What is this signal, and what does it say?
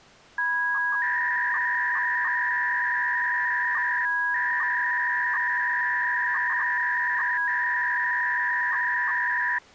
300-baud modem data (V.21 tones), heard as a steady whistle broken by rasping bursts, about 300 baud, 200 Hz shift.